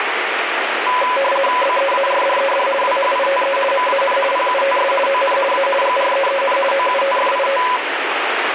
RTTY (50 baud, 450 Hz shift), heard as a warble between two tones, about 770 Hz centre, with radio static. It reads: BEARDED WHITE MAN PUTS ON A GREEN OUTFIT